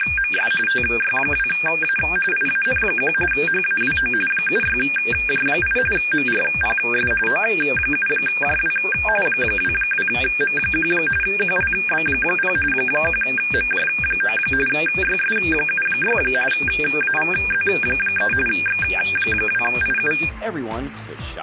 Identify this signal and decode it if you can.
RTTY (45.45 baud, 850 Hz shift), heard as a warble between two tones, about 2000 Hz centre. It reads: … TY2A IAN1 HAWO 76J8 MRPS O7JW 22M1 QLB0 1MJ9 YS76 AVZ3 X2IU